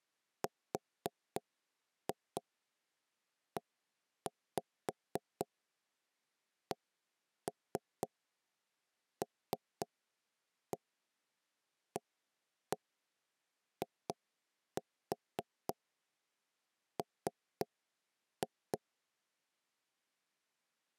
Tap code, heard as knocks on wood, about 3 knocks a second. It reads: RECLAIM